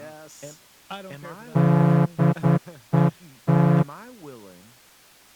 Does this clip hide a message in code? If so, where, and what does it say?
Yes: Morse code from 1.5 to 3.9 s, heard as a horn, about 10 wpm, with speech in English. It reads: DET